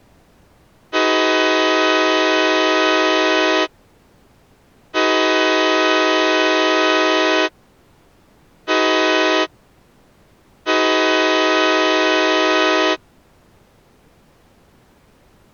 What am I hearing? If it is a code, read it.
Train horn signal, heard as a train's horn. 2 long, 1 short, 1 long. On North American railways: approaching a public crossing.